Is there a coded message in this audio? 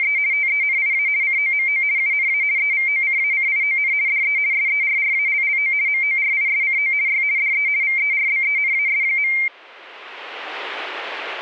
Yes: RTTY (50 baud, 170 Hz shift) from 0.0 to 9.5 s, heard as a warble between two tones, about 2200 Hz centre. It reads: … TENIA COMO UNA EVOCACION DE SERRALLO MORISCO Y DE VERBENAS.